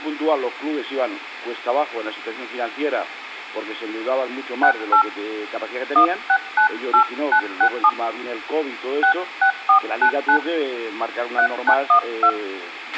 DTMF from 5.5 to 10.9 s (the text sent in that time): 1698967 66499